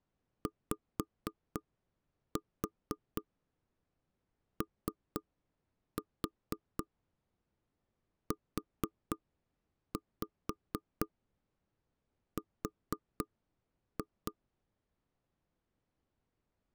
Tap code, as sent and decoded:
5-4 3-4 4-5 4-2
YOUR

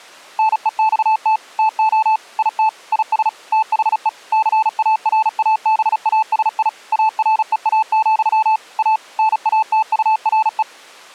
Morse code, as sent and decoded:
-. . -..- - / - --- / .. - / .. ... / - .... . / -.-. .- .-. .- -... .- ... .. / .- .-. . .- --..-- / .- / -. .- - ..- .-. .
NEXT TO IT IS THE CARABASI AREA, A NATURE

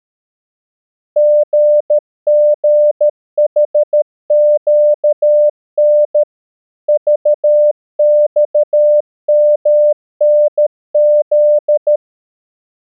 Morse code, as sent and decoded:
--. --. .... --.- -. / ...- -..- -- -. --..
GGHQN VXMNZ

